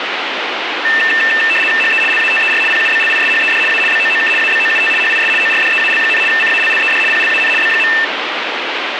RTTY (75 baud, 850 Hz shift), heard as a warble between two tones, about 2250 Hz centre, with radio static. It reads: HE LATER PUBLISHED A BOOK ABOUT HIS ORDEAL, CALLED PLAN B.